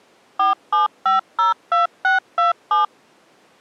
DTMF, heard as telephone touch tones, dialled by machine, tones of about 140 ms. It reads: 47502627